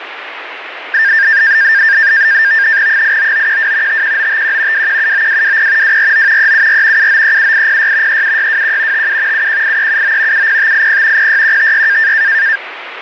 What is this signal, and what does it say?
NAVTEX (SITOR-B), 100 baud, 170 Hz shift, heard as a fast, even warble, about 1700 Hz centre, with radio static. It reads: 89912 51951 2179220 249 374 7937806 37621 57 718379 70580 06156